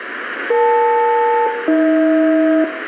Aircraft SELCAL, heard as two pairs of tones, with radio static and room echo. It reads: EL-AH